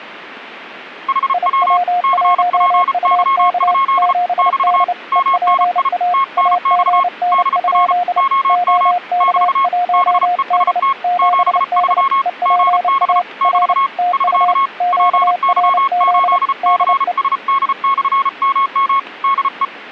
Morse code, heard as two keyed tones. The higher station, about 34 wpm, 1090 Hz: HW CPY? <BT> MNI TNX DR OM <BT> BEST 73 GB <BT> <SK> PY8CSD/MM DE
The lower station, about 29 wpm, 710 Hz: IW1UK 7D EPA AGN? OK1D 7D EPA R TU QRZ DE